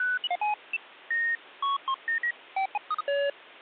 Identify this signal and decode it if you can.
Electronic bleeps of random pitch and length, with phone line noise. There is no code.